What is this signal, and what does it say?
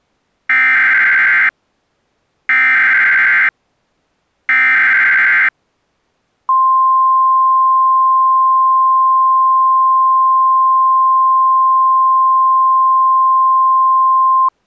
Emergency Alert System (SAME) tones (header bursts, then the 1050 Hz attention tone), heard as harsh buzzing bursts, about 520.83 baud.